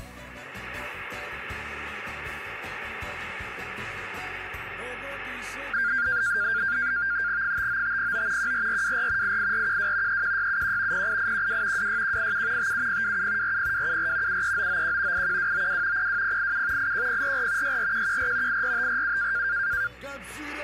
NAVTEX (SITOR-B), 100 baud, 170 Hz shift, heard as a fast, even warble, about 1500 Hz centre. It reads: 59509 14424 88412 31671 08812 26187 57027 40274 73991 81292 02087 81044 64114 84547